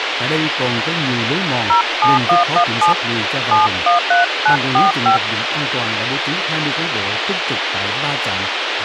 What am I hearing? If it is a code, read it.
DTMF, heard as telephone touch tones, dialled by hand, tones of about 120 ms, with radio hiss and speech in Vietnamese. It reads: 07117 713945